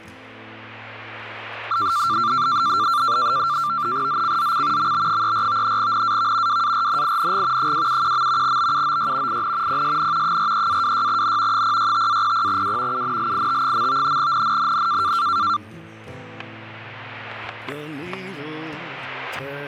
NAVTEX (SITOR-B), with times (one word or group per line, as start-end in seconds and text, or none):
4.1-4.9 ZCZC
4.8-5.8 MB34
5.8-6.6 NAV
6.5-7.7 WARNING
7.6-8.6 271.
8.4-9.4 BUOY
9.3-9.8 IN
9.7-10.4 PSN
10.2-11.6 43-26N
11.5-13.0 065-00W
12.9-14.2 UNLIT.
14.2-15.1 NNNN